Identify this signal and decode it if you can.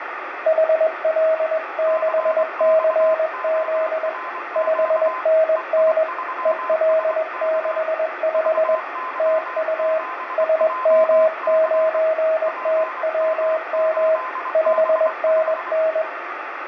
Morse code, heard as two keyed tones, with radio static, fading and room echo. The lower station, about 21 wpm, 640 Hz: HL6CZ 5NN EL65 TU SM9TWM 5NN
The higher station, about 24 wpm, 1030 Hz: CXORQ EI3SK VY7JC PM8B5